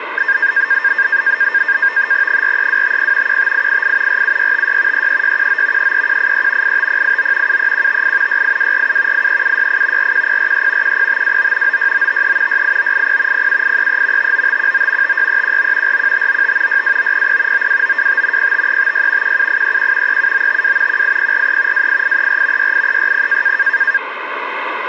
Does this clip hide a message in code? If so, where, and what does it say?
Yes: NAVTEX (SITOR-B), 100 baud, 170 Hz shift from 0.2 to 24.0 s, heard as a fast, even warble, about 1700 Hz centre, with radio static. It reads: 43250 15888 47656 33619 33183 85089 73158 68247 83768 41043 10529 96953 68980 07833 59519 56319 41595 62900 92925 05356 17831 37952 18043 28834 68360